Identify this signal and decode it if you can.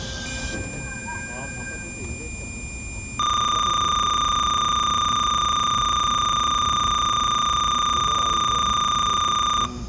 Cassette data (Kansas City type), 300 baud, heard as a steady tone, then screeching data, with the noise inside a subway train.